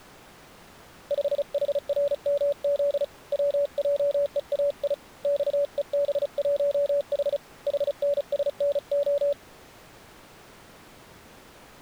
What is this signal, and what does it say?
Morse code, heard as a keyed tone, hand-sent with a paddle, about 35 wpm, 570 Hz. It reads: 5HRMZ WJEAI XEB1H HNSNO